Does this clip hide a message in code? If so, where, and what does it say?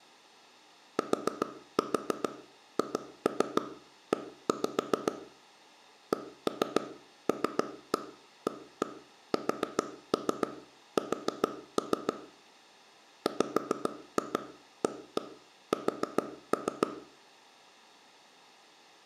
Yes: tap code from 1.0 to 16.9 s, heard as taps on a table, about 7 knocks a second, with room echo. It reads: THE CLASS WAS